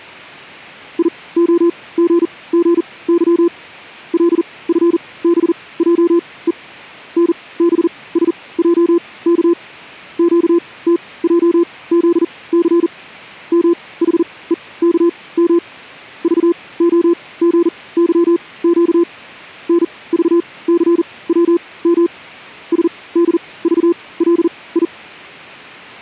Morse code, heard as a keyed tone, machine-sent, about 40 wpm, spaced as for 22 wpm, 340 Hz. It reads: IOGGY LFBJE NBSJK QTJZC MHEKM VOGYQ NVCWM SDVLI